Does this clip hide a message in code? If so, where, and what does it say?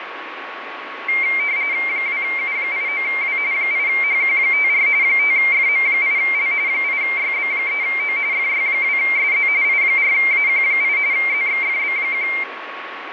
Yes: RTTY (45.45 baud, 170 Hz shift) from 1.1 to 12.4 s, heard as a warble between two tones, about 2200 Hz centre, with radio static and a steady whistle near 1110 Hz. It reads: 2U89W 8HQ54 5FM8L 8YB3O FY2SZ I4AQ8 ZXFB1